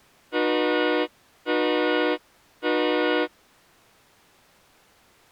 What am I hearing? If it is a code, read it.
Train horn signal, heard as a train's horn. 3 short. On North American railways: when stopped, the train will back up.